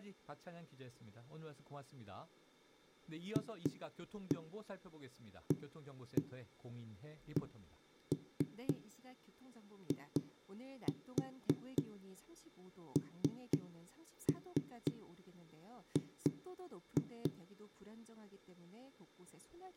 Tap code, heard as knocks on a wall, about 3 knocks a second, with room echo and speech in Korean. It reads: FACING